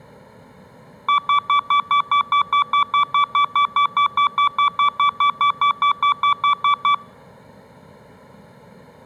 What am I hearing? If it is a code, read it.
Evenly repeated beeps, with room echo. There is no code.